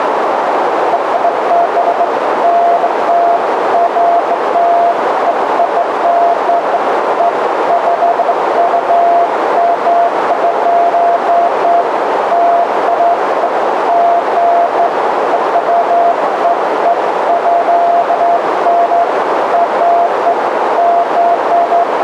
Beeps of irregular length, with heavy radio static and a narrow filter. There is no code.